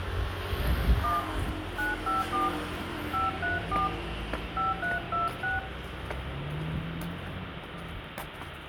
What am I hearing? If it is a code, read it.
DTMF, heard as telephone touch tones, dialled by hand, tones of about 160 ms, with phone line noise, room echo and the noise of a residential street. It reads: 1 954 534 5326